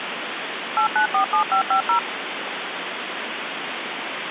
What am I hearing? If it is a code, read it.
DTMF, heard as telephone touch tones, dialled by machine, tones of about 100 ms, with phone line noise. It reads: 8947550